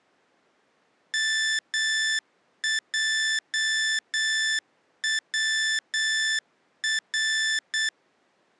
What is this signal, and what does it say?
Morse code (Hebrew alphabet), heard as electronic beeps, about 8 wpm, 1750 Hz. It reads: מעצר